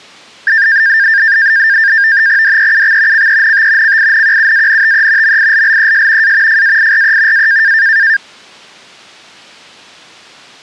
NAVTEX (SITOR-B), 100 baud, 170 Hz shift, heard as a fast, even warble, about 1700 Hz centre. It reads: DEUX CENT CINQUANTE MILLES A FAIRE A